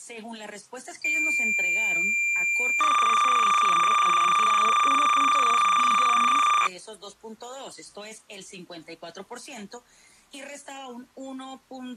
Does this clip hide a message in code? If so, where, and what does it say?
Yes: cassette data (Kansas City type), 300 baud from 1.0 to 6.7 s, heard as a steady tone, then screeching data.